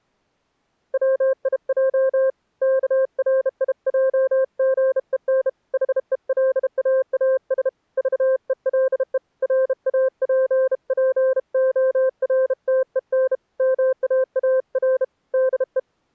Morse code, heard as a keyed tone, hand-sent with a bug key, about 32 wpm, 520 Hz. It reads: WIJ KRIJGEN HELAAS VELE RAPPORTEN MAAR DE